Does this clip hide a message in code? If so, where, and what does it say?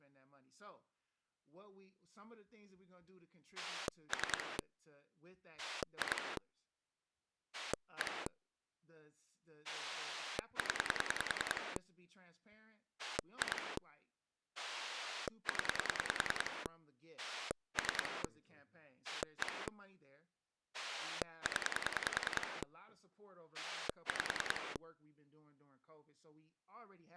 Yes: pulse dialling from 3.6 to 24.8 s, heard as a rotary dial, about 10 pulses a second, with speech in English. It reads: 3 2 1 0 2 0 3 1 0 5